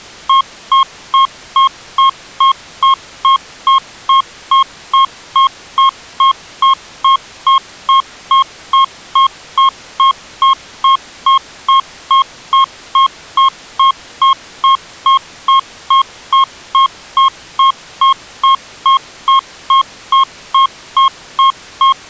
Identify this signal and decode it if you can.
Evenly repeated beeps. There is no code.